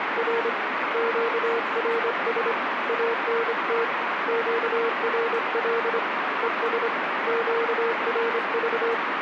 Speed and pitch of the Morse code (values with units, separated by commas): 25 wpm, 460 Hz